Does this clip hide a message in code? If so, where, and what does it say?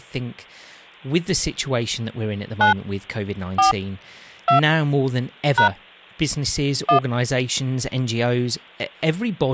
Yes: DTMF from 2.6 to 7.0 s, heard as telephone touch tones, dialled by hand, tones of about 110 ms, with speech in English. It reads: 9 4 2 # 1